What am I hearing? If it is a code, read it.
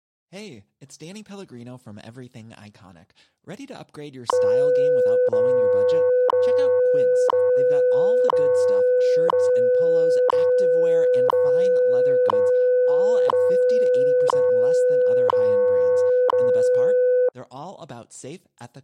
Radio time signal (WWV, Colorado), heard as ticks, one a second, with speech in French.